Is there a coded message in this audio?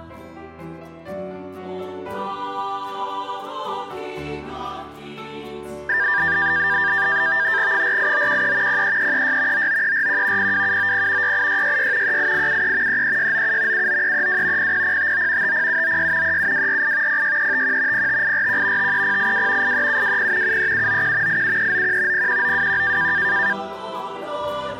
Yes: NAVTEX (SITOR-B), 100 baud, 170 Hz shift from 5.9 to 23.5 s, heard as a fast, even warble, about 1700 Hz centre. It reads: 48913 03336 99341 02790 68666 38873 33697 79332 00059 50796 37248 06351 05841 53082 83720 73791 87391 01921